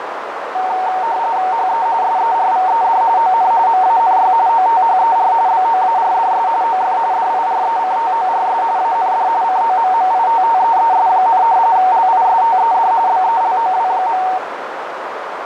RTTY (45.45 baud, 170 Hz shift), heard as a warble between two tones, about 830 Hz centre, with radio static and a narrow filter. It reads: HE SERVED ON MANY OTHER BOARDS OF DIRECTORS AND COMMITTEES, LISTED BELOW.